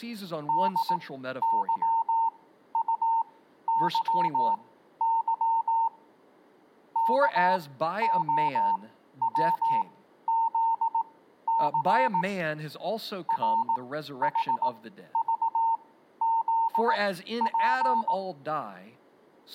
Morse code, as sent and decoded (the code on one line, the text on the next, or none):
-.. -.-- ..- -.-- -.-- / -.- --- .-- --.. -.-. / .-. .... ...- --.. .--.
DYUYY KOWZC RHVZP